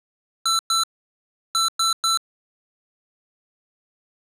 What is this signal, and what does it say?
Beep code, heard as beeps from a small speaker, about 1340 Hz. 2-3.